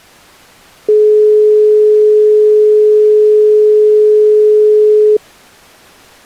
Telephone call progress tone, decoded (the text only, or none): dial tone